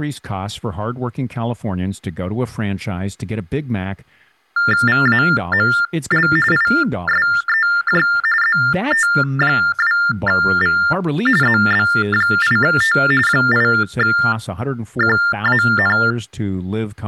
TTY/TDD text telephone tones (45.45 baud Baudot), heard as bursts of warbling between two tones, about 400 Hz shift, 1600 Hz centre, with speech in English. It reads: VAML ISEJ ZT2V ZB8T 8QAN